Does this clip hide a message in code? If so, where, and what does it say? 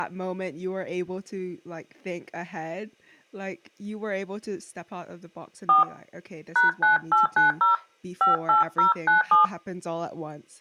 Yes: DTMF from 5.7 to 9.5 s, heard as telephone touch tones, dialled by hand, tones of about 140 ms, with speech in English. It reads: 4 #9890 58097